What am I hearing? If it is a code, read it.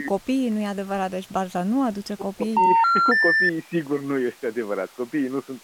Telephone call progress tone (North American plan), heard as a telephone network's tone, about 910, 1370, 1800 Hz. Special information tone.